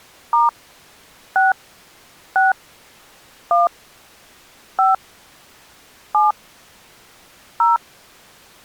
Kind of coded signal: DTMF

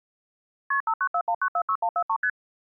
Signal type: multi-frequency trunk signalling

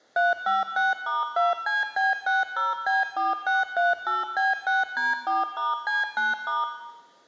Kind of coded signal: DTMF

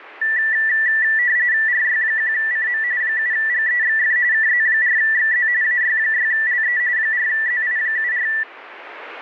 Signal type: RTTY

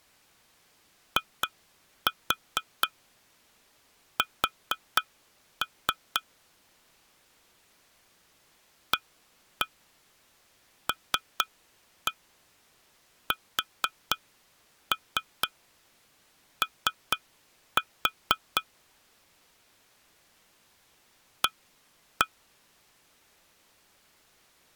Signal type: tap code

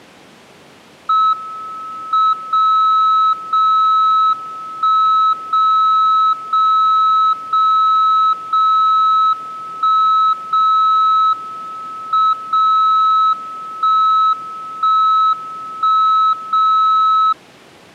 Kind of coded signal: radio time signal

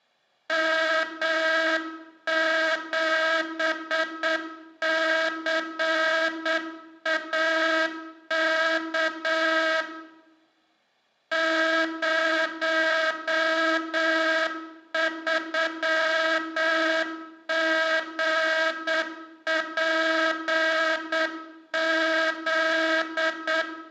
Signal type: Morse code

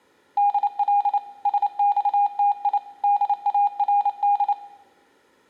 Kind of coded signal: Morse code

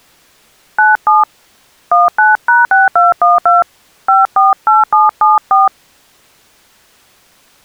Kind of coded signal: DTMF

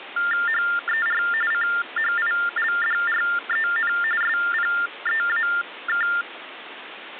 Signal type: TTY/TDD text telephone tones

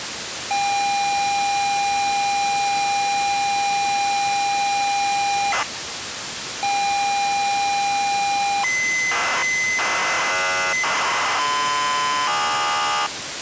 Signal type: ZX Spectrum tape loading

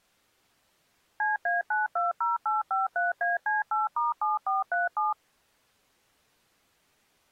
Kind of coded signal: DTMF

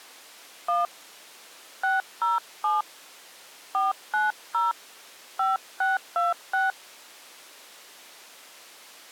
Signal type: DTMF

